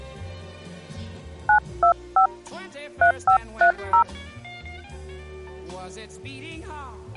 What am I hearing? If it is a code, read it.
DTMF, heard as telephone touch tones, dialled by hand, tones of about 100 ms. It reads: 925 3530